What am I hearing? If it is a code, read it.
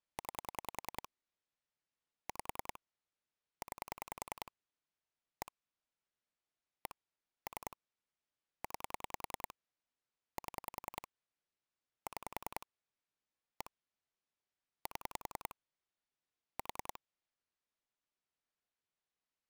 Pulse dialling, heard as clicks on a phone line, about 10 pulses a second. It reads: 9 5 9 1 1 3 9 7 6 1 7 4